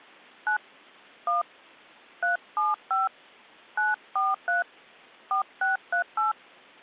DTMF, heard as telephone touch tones, dialled by hand, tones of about 140 ms. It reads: 9 1 375 943 4638